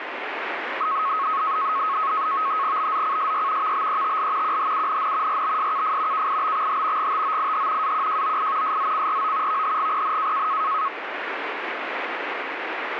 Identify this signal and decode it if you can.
NAVTEX (SITOR-B), 100 baud, 170 Hz shift, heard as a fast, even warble, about 1180 Hz centre, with radio static. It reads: BZCSY VBETL QHUNN RBSKF KIBXH GTOIH AQJOI SZCRO VHGPN